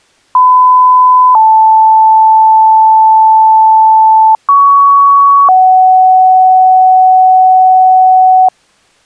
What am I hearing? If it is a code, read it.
Two-tone page, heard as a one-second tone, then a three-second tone, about 1010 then 880 Hz, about 1120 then 750 Hz.